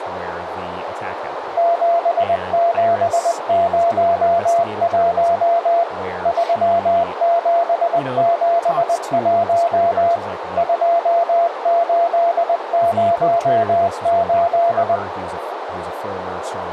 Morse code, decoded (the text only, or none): 7701 3771 2808